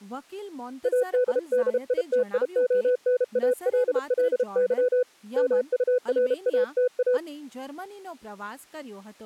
Morse code, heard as a keyed tone, hand-sent with a paddle, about 32 wpm, 500 Hz, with speech in Gujarati. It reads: ADDITIONALLY MURATA